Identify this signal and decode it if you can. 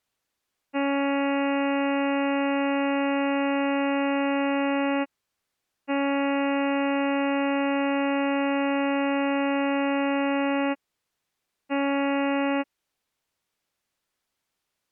Ship horn signal, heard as a ship's horn, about 280 Hz. 2 long, 1 short. At sea: I intend to overtake on your starboard side.